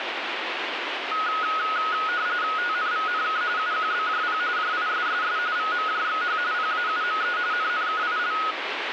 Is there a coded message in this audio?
Yes: RTTY (45.45 baud, 170 Hz shift) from 1.1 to 8.5 s, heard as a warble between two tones, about 1360 Hz centre, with radio static. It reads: TNVNK UQBJP JISSS VMJXH PAUME NNKIL